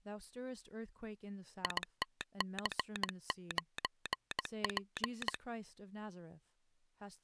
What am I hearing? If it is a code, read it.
Morse code, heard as a telegraph sounder, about 18 wpm, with speech in English. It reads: ITC9P